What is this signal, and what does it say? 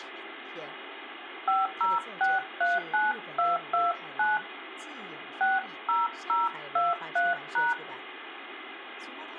DTMF, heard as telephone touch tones, dialled by hand, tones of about 180 ms, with phone line noise and speech in Chinese. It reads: 50639229 60023#